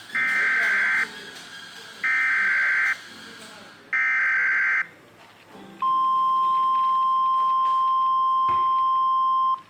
Emergency Alert System (SAME) tones (header bursts, then the 1050 Hz attention tone), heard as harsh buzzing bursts, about 520.83 baud, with the noise of a cafe.